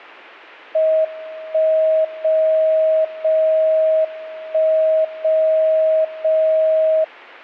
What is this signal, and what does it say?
Radio time signal (WWVB), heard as a tone whose level steps once a second, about 630 Hz. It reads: 1 0 0 1 0 0